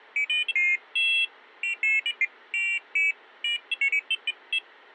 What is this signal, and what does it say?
Pairs of high tones at irregular times. There is no code.